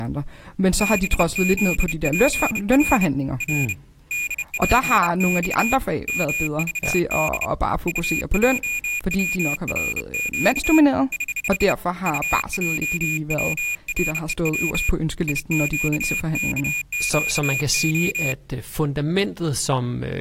Morse code, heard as a high beeper, hand-sent with a bug key, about 30 wpm, 2450 Hz, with speech in Danish. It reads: BZPR R DPX MVD UJWRQ <HH> UJWREW IQKQO